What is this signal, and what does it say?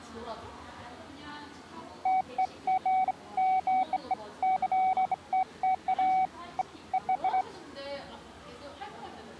Beeps of irregular length, with the noise of a crowd indoors. There is no code.